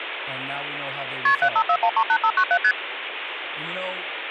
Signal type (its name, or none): multi-frequency trunk signalling